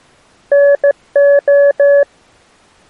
Morse code (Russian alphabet), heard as a keyed tone, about 15 wpm, 570 Hz. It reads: НО